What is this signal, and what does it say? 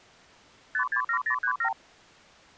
Multi-frequency trunk signalling (R2, with the far end's replies), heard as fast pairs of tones, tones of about 80 ms. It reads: 567037